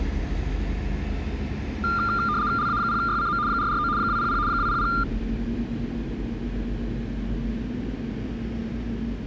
RTTY (75 baud, 170 Hz shift), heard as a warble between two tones, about 1290 Hz centre, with street noise. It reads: LA0YCM 449 200 200